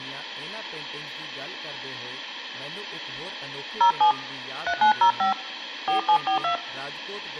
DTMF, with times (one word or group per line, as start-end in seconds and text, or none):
3.8-4.1 07
4.7-5.3 3905
5.9-6.5 4742